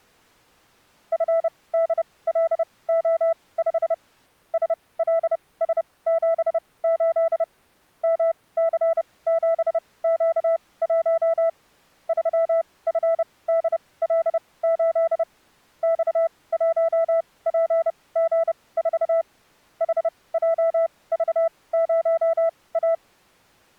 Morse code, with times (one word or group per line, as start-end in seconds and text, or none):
1.1-3.9 FDLO5
4.5-7.4 SLS78
8.0-11.5 MC7Q1
12.1-15.2 3FDL8
15.8-19.2 X1PG4
19.8-22.9 HJV0A